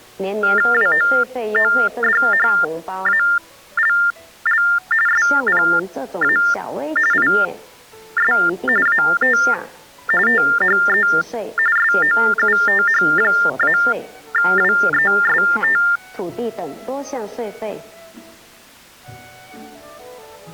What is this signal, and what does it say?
TTY/TDD text telephone tones (45.45 baud Baudot), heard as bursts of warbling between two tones, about 400 Hz shift, 1600 Hz centre. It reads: WOODHALL SPA IS AT THE SOUTH-WEST